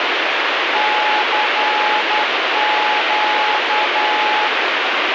Morse code, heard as a keyed tone, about 10 wpm, 850 Hz, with heavy radio static. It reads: CQ